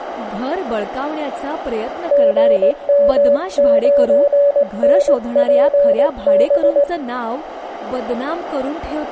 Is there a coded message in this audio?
Yes: Morse code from 2.1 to 6.9 s, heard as a keyed tone, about 18 wpm, 570 Hz, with room echo and speech in Marathi. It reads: GM9NPB